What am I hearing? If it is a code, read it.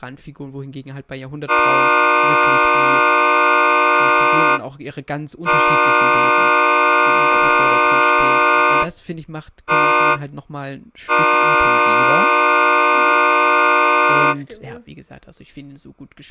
Train horn signal, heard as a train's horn, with speech in German. 2 long, 1 short, 1 long. On North American railways: approaching a public crossing.